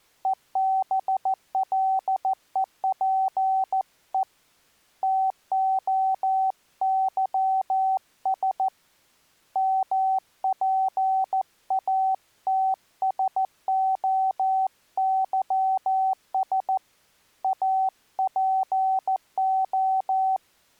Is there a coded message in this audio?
Yes: Morse code (Greek alphabet) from 0.2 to 20.4 s, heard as a keyed tone, hand-sent with a paddle, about 14 wpm, 760 Hz. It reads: ΕΒΛΕΠΕ ΤΟΥΣ ΜΠΑΤΣΟΥΣ ΑΠΟ